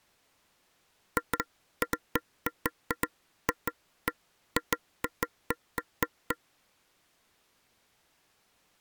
Irregular taps on a table. There is no code.